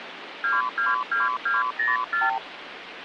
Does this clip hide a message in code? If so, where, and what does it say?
Yes: multi-frequency trunk signalling (R2, with the far end's replies) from 0.4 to 2.4 s, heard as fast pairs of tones, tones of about 170 ms, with phone line noise. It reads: 222204